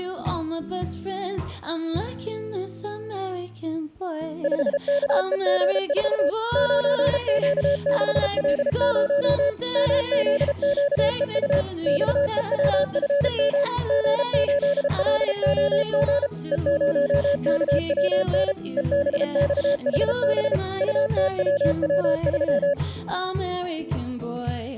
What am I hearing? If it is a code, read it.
Morse code, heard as a keyed tone, machine-sent, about 33 wpm, 570 Hz. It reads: 5KEG4 9Q6L0 MZQEU XEWFM G8LOG E0KWN EBXHB UTWW3